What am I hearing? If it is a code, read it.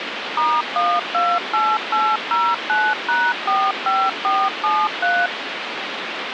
DTMF, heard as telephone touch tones, dialled by machine, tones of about 240 ms, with phone line noise. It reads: *128809#45473